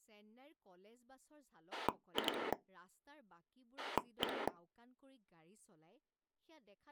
Pulse dialling, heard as a rotary dial, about 10 pulses a second, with speech in Assamese. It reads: 2 1